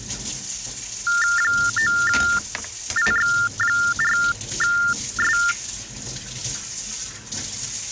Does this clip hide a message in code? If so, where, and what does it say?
Yes: TTY/TDD text telephone tones (45.45 baud Baudot) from 1.1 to 5.5 s, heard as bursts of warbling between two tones, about 400 Hz shift, 1600 Hz centre, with kitchen noise. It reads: 9IX4S